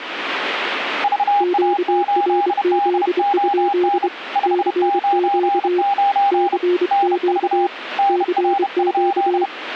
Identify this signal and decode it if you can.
Morse code, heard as two keyed tones, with radio static. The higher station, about 31 wpm, 800 Hz: VA8DON 599 NV NR?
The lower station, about 24 wpm, 360 Hz: QRZ? CQ CQ CQ